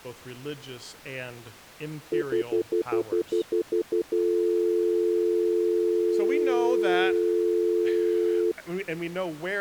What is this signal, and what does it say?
Telephone call progress tone (North American plan), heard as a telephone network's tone, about 350, 440 Hz, 0.1 s on and 0.1 s off, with speech in English. Stutter dial tone.